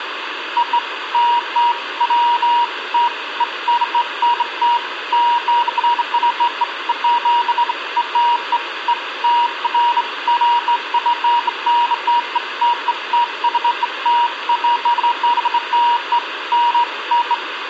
Beeps of irregular length, with radio hiss and room echo. There is no code.